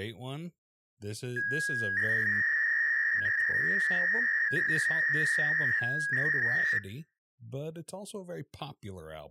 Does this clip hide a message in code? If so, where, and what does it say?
Yes: 300-baud modem data (V.21 tones) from 1.4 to 6.8 s, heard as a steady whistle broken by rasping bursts, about 300 baud, 200 Hz shift, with speech in English.